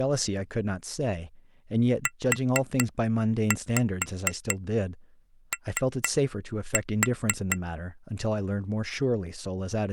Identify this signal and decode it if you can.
Tap code, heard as taps on glass, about 4 knocks a second, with speech in English. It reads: UO